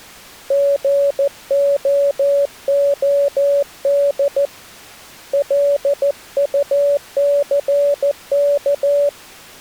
Morse code, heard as a keyed tone, hand-sent with a paddle, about 14 wpm, 570 Hz. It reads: GOOD LUCK